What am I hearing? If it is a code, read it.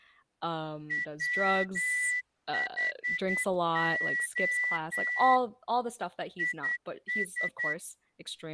Morse code, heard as a whistle, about 9 wpm, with speech in English. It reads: WHO IS